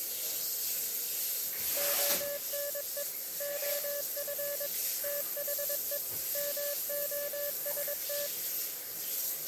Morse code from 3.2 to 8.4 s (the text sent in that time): OF THE MOST